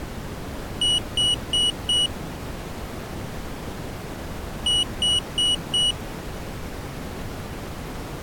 Beep code, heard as a piezo beeper, played twice, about 2950 Hz. 4 short. In AMI BIOS tables: system timer failure; in Dell tables: memory read or write failure.